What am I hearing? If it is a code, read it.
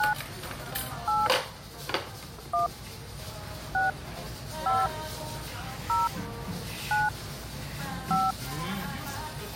DTMF, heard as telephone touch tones, dialled by hand, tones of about 160 ms, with the noise of a restaurant. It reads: 9 8 1 6 5 0 9 5